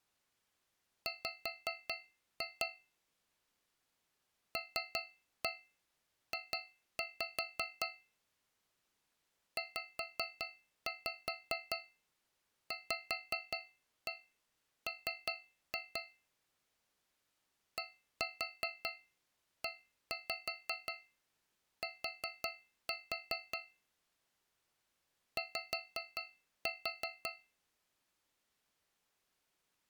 Tap code, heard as taps on a metal pipe, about 5 knocks a second. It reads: W LJ ZVM DET Y